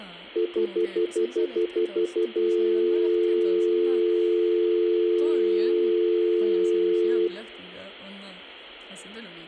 Telephone call progress tone (North American plan), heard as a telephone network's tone, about 350, 440 Hz, 0.1 s on and 0.1 s off, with room echo and speech in Spanish. Stutter dial tone.